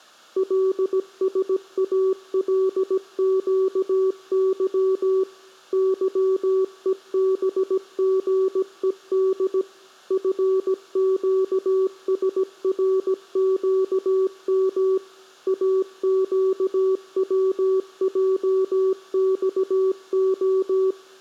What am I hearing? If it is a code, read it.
Morse code, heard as a keyed tone, machine-sent, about 17 wpm, 380 Hz, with room echo. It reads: LSALQY YEBGED FQSRQM AQWJXO